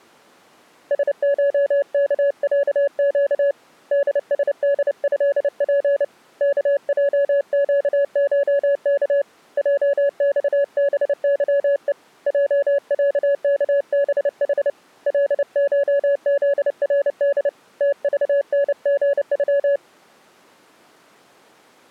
Morse code (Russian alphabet), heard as a keyed tone, hand-sent with a paddle, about 29 wpm, 560 Hz. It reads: СШКЯЩ ДСДЭП КЙЩШК ЙЬБЫЕ ЙЯКБХ ЛШЗРД ТЖНГЮ